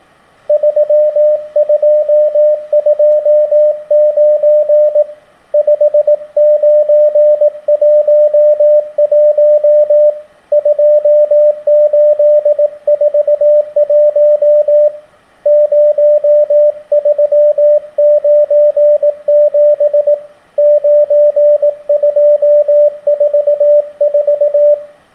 Morse code, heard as a keyed tone, hand-sent with a paddle, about 18 wpm, 600 Hz, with room echo. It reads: 3229 5911 2841 0397 9244